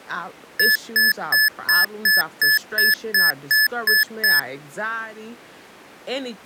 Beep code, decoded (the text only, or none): 11 short